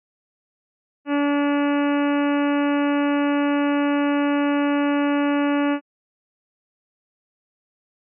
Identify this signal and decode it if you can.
Ship horn signal, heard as a ship's horn, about 290 Hz. 1 long. At sea: a vessel nearing a blind bend, or under power and making way in fog.